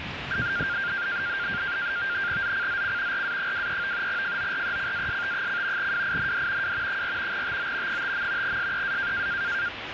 NAVTEX (SITOR-B), 100 baud, 170 Hz shift, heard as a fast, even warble, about 1500 Hz centre, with radio static and street noise. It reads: ZCZC RA23 FORECAST: WIND W 4 TO 5. SEA